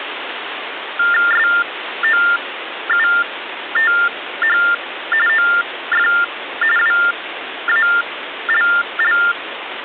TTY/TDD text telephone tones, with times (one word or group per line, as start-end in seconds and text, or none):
1.3-4.6 SOUTH
5.3-6.1 OF
6.8-9.2 WALL